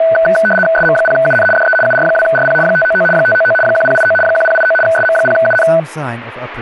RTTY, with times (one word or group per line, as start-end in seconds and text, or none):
0.8-1.5 SM0UN
1.6-1.8 DE
1.9-2.6 UR2RP
2.7-3.1 599
3.2-3.6 599
3.7-4.2 1089
4.2-4.8 1089
4.9-5.7 SM0UN